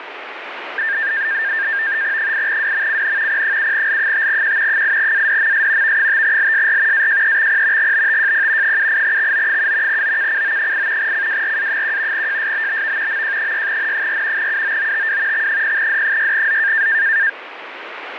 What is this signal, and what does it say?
NAVTEX (SITOR-B), 100 baud, 170 Hz shift, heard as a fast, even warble, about 1700 Hz centre, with radio static. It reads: 8WMCN P7L5Q 8ADMS V5LSR AJEXP GBTJP 78XO7 OKCO8 CWRA1 JSBBV MJ6N4 UOOTW X0D6Z